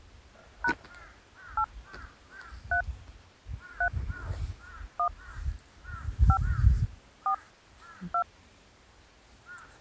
DTMF, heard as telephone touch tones, dialled by hand, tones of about 80 ms, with the noise of a park. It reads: # 8 3 3 1 5 4 2